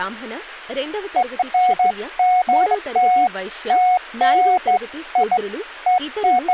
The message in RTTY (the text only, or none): none